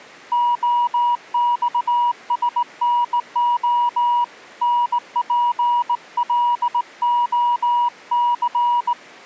Morse code, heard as a keyed tone, hand-sent with a straight key, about 18 wpm, 960 Hz. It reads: OXSNO NPLOC